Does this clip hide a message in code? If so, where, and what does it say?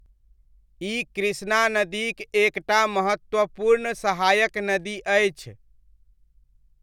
No, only speech in Maithili.